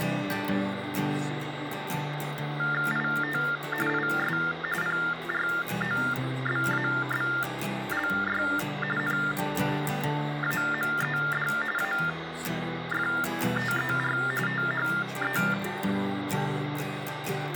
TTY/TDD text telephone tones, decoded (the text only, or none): IT IS PROBABLY NAMED AFTER THE